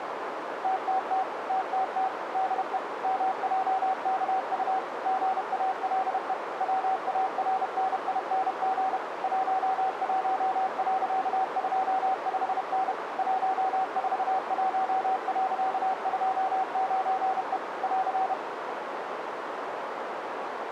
Morse code, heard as a keyed tone, machine-sent, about 31 wpm, 760 Hz, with radio static and a narrow filter. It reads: TTT TTT DE MJKU GALE WARNING 11.25N 141.29E <AR>